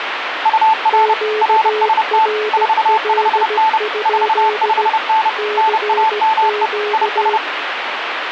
Morse code, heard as two keyed tones, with radio static. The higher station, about 30 wpm, 880 Hz: UR RST 45N 45N NAME IS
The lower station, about 16 wpm, 420 Hz: QRL? CQ